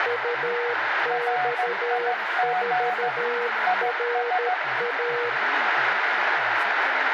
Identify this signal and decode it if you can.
Morse code, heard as two keyed tones, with radio static, room echo and speech in Hindi. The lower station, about 13 wpm, 480 Hz: UX4RA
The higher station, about 15 wpm, 730 Hz: RIG IS